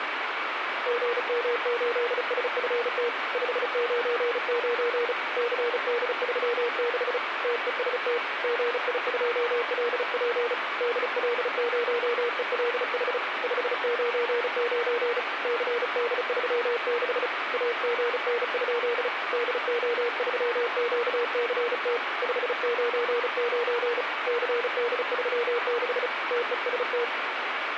Morse code, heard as a keyed tone, hand-sent with a paddle, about 35 wpm, 470 Hz, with radio static. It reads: GM8SFT 599 CD36 TEST GI2LP DL0ELH 599 CD36 AGN? DO3QCT 599 CD36 TEST